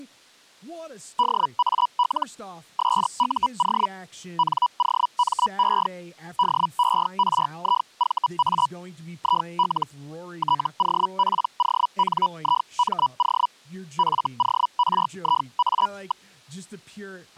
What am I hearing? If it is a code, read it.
Hellschreiber (Feld-Hell, 122.5 baud), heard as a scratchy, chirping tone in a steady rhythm, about 980 Hz, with speech in English. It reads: DAL SUO NOME DERIVA IL TOPONIMO FORIA.